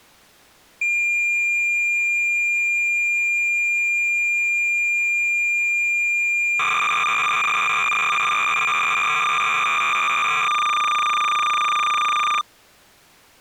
Cassette data (Kansas City type), 300 baud, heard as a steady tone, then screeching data.